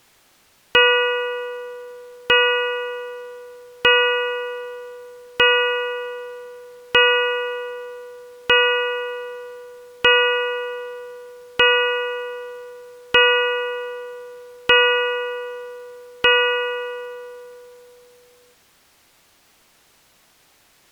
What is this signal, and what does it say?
Clock strike, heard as a bell. 11. Eleven o'clock.